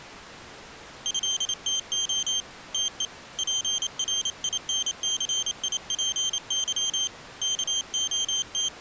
Morse code (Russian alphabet), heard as a high beeper, hand-sent with a paddle, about 28 wpm, 3150 Hz. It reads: ЭТО ТЕ ПРИНЦИПЫ …